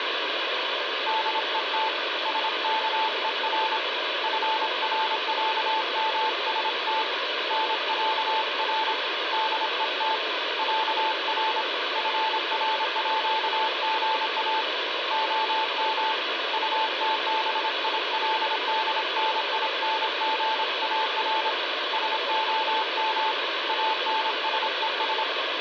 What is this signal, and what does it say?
Morse code (with Swedish letters), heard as a keyed tone, hand-sent with a paddle, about 26 wpm, 880 Hz, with radio static. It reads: DET SKER FRÄMST NÄR DET ÄR FRÅGA OM UTBILDNINGAR SOM ANSES